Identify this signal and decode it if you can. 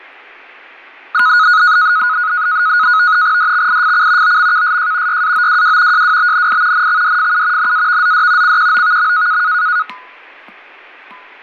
NAVTEX (SITOR-B), 100 baud, 170 Hz shift, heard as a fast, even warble, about 1360 Hz centre, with fading. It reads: DXIFC OMKSJ YAOWW JWBNI NXDFU NAVZD CQOVM